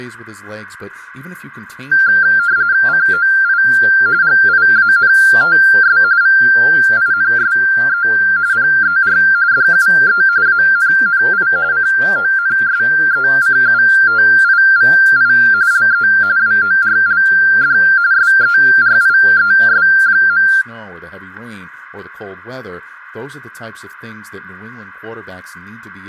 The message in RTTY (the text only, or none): COI GIANTS VINSE PER DUE ANNI CONSECUTIVI LE WORLD SERIES.